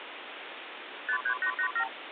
Multi-frequency trunk signalling (R2, with the far end's replies), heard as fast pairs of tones, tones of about 80 ms, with phone line noise. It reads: 53887